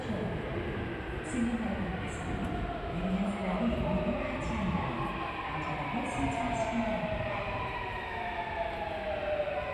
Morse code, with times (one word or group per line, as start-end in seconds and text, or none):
none